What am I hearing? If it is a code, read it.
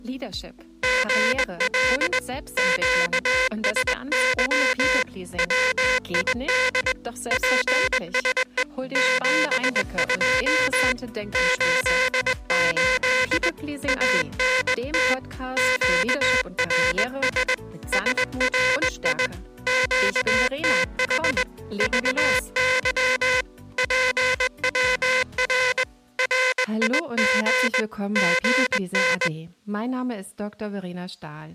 Morse code, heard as a buzzer, hand-sent with a straight key, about 20 wpm. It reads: GL QSY WID PSE 72 88 ANT QRS SRI QTH VY PWR RIG GN